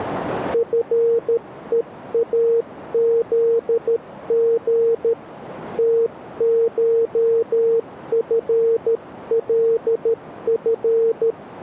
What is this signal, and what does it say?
Morse code (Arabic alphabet), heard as a keyed tone, hand-sent with a paddle, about 13 wpm, 460 Hz, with radio static. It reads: فءاذغ تشفلف